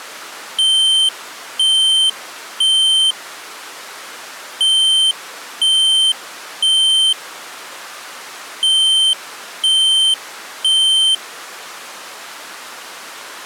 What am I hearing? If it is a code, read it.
Alarm pattern, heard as an alarm's beeps, played three times, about 3100 Hz. Temporal three. Smoke or fire, evacuate.